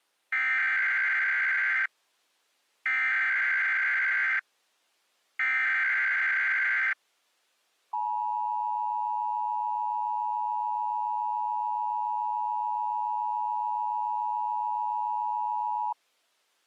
Emergency Alert System (SAME) tones (header bursts, then the 853 and 960 Hz attention tone), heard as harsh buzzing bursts, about 520.83 baud.